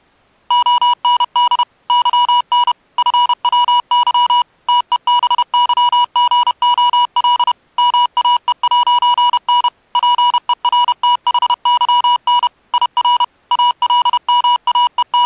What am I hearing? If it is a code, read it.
Morse code, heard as electronic beeps, machine-sent, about 31 wpm, 970 Hz. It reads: OND YN FWY TEBYGOL MAE'N PERTHYN IR …